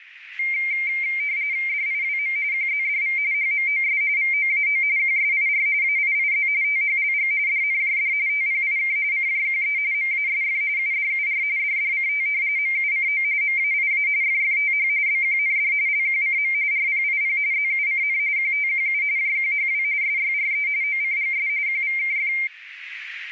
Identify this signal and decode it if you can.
RTTY (45.45 baud, 170 Hz shift), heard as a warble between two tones, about 2200 Hz centre, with radio static. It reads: DIWM QZDV HMOS VOAO QSIR AIIZ THLG DNJD TPIK CJQE MASF UDUR DDCT MUCO MAIA FFTH BQND LQCM RPIP ZUCN QTQU JQHW SYRE OCGS QVKF